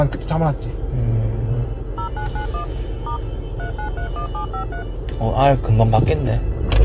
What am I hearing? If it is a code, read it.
DTMF, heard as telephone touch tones, dialled by machine, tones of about 100 ms, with the noise inside a car. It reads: 0991 * 3931753